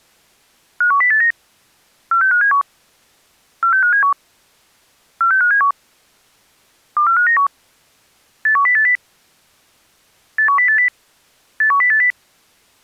Five-tone selective call (CCIR), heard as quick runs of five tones, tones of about 100 ms. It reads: 51089 46571 46571 46571 24591 81080 81080 81080